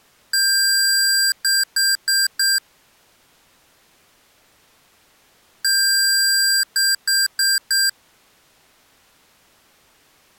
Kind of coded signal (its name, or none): beep code